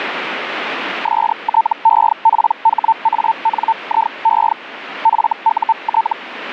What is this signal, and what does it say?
Hellschreiber (Feld-Hell, 122.5 baud), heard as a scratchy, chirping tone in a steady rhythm, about 900 Hz, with radio static. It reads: STEPHANIE FUT